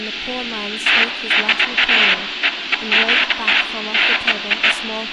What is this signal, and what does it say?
Bursts of noise, with phone line noise, room echo and speech in English. There is no code.